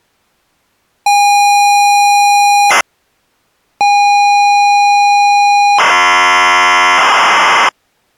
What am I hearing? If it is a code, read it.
ZX Spectrum tape loading, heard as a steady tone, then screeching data.